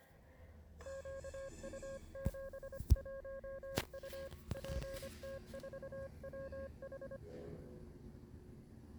Morse code, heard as a keyed tone, hand-sent with a paddle, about 25 wpm, 540 Hz, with the noise inside a lift. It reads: QU71U PT4WH